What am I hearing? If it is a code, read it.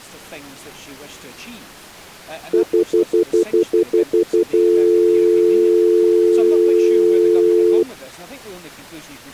Telephone call progress tone (North American plan), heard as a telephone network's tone, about 350, 440 Hz, 0.1 s on and 0.1 s off. Stutter dial tone.